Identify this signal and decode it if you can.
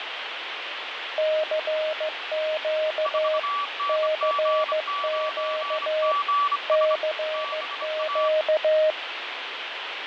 Morse code, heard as two keyed tones, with radio static and fading. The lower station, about 15 wpm, 620 Hz: CQ CQ CQ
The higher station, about 25 wpm, 1150 Hz: 4NG9GS BA